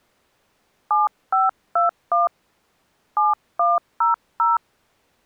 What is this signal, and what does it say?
DTMF, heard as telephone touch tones, dialled by hand, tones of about 160 ms. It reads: 7521 7100